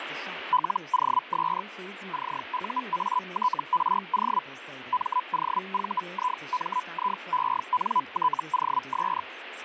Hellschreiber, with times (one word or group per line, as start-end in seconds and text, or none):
0.5-1.6 LOS
2.1-4.4 CUATRO
4.9-9.2 MOVIMIENTOS